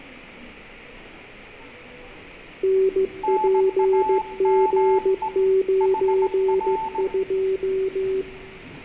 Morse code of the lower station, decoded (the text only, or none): NPG92